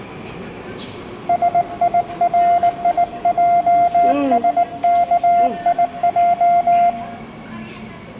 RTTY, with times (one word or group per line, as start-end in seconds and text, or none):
none